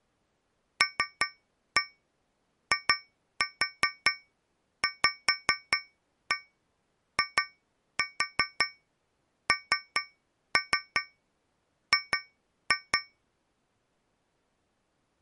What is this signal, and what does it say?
Tap code, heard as taps on a metal pipe, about 5 knocks a second. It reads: LIVING